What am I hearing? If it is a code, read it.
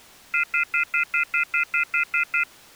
Telephone call progress tone (North American plan), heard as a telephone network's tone, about 1400, 2050, 2450, 2600 Hz, 0.1 s on and 0.1 s off. Off-hook warning tone.